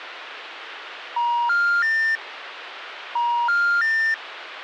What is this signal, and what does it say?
Telephone call progress tone (ITU plan), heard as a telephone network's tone, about 950, 1400, 1800 Hz, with phone line noise. Special information tone.